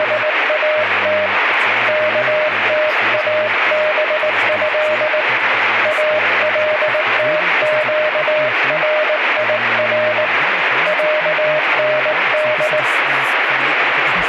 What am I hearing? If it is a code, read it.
Morse code (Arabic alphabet), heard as a keyed tone, hand-sent with a paddle, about 19 wpm, 610 Hz, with radio static and speech in German. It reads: … كتابه التقرير عند